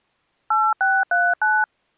DTMF, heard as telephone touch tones, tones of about 230 ms. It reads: 8639